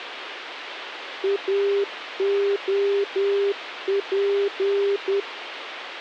Morse code, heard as a keyed tone, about 10 wpm, 400 Hz, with radio hiss. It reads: AOP